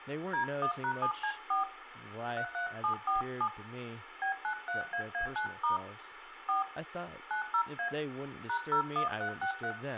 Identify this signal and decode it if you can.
DTMF, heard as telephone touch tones, dialled by hand, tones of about 110 ms, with phone line noise, room echo and speech in English. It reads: D1#7C4 33747 B93AA9* 4 90A #01363